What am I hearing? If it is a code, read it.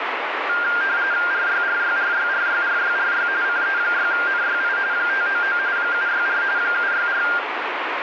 RTTY (45.45 baud, 170 Hz shift), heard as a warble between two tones, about 1500 Hz centre, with radio static. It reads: RYRYRYRYRYRY CE6NYI 599 764 764